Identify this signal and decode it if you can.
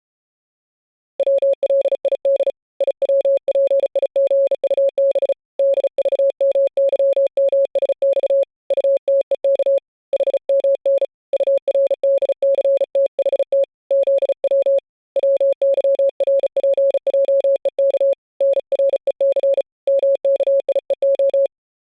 Morse code, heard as a keyed tone, hand-sent with a bug key, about 35 wpm, 550 Hz. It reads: WLID IWPIGUB DVMYMSX UTEK HMN URDCTHT ZW WYRPJEK NREC MKIEO